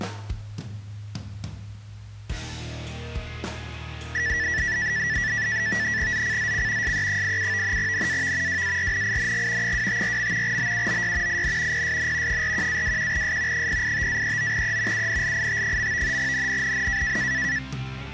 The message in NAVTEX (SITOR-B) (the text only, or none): ZCZC SE87 NAV WARNING 254. BUOY IN PSN 41-21S 085-39E UNLIT. NNNN